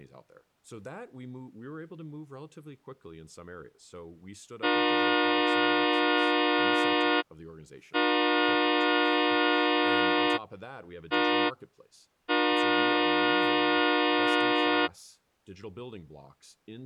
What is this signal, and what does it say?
Train horn signal, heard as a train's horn, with speech in English. 2 long, 1 short, 1 long. On North American railways: approaching a public crossing.